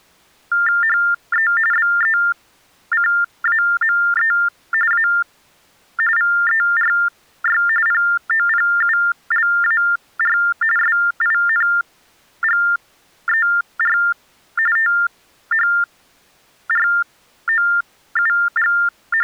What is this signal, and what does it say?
TTY/TDD text telephone tones (45.45 baud Baudot), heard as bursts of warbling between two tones, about 400 Hz shift, 1600 Hz centre. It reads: HE BECAME A VERY POPULAR SINGER …